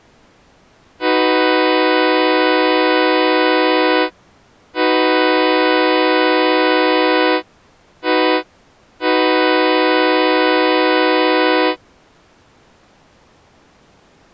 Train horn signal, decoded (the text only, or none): 2 long, 1 short, 1 long